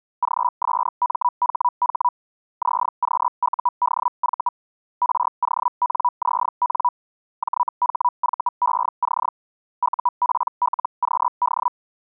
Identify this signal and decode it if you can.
Hellschreiber (Feld-Hell, 122.5 baud), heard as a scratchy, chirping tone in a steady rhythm, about 980 Hz. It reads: GSMHH ZQUDV RONZN JHVEC UPLQD